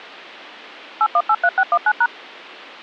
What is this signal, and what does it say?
DTMF, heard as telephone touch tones, dialled by machine, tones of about 60 ms. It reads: 8183619#